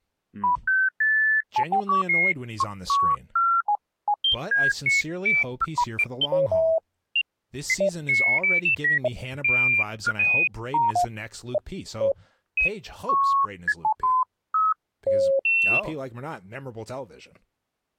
Electronic bleeps of random pitch and length, with speech in English. There is no code.